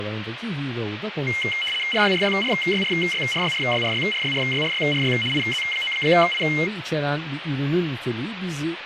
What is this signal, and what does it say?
RTTY (75 baud, 850 Hz shift), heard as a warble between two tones, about 2550 Hz centre, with radio static and speech in Turkish. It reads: RYRYRYRYRYRYRYRYRYRYRY IZ9I